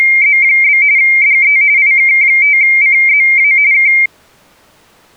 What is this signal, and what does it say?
RTTY (45.45 baud, 170 Hz shift), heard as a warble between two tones, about 2200 Hz centre. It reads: … DE IK5CZA K